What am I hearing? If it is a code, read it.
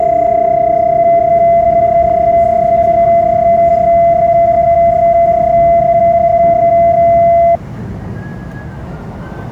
PSK31 (31.25 baud), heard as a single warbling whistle, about 680 Hz, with static crashes and the noise inside a subway train.